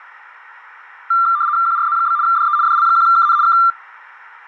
RTTY (75 baud, 170 Hz shift), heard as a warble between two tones, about 1280 Hz centre. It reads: QRZ? DE DL1KN K